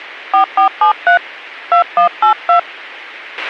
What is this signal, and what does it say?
DTMF, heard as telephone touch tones, dialled by hand, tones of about 110 ms, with a squelch burst at the end. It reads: 4473 2182